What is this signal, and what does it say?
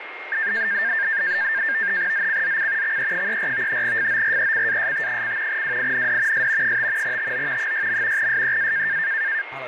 NAVTEX (SITOR-B), 100 baud, 170 Hz shift, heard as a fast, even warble, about 1700 Hz centre, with radio static, a steady whistle near 2130 Hz and speech in Slovak. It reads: ZCZC XE34 FORECAST: WIND S 5 TO 6. SEA